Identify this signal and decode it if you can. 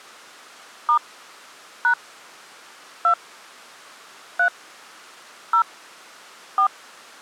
DTMF, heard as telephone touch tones, dialled by hand, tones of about 90 ms. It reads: * # 2 3 0 4